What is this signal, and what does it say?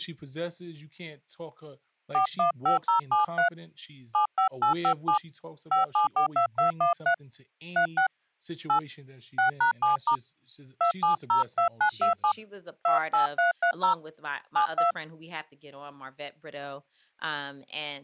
DTMF, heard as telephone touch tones, dialled by hand, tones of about 110 ms, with speech in English. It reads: 415073 75857 5742213 36 8 6#7* 2702927 28330 72